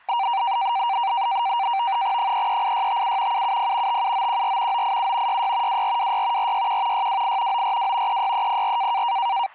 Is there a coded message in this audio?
Yes: NAVTEX (SITOR-B), 100 baud, 170 Hz shift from 0.1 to 9.5 s, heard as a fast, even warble, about 860 Hz centre, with street noise. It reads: 338657 770 57914 987 66 2426 461 628 942 36304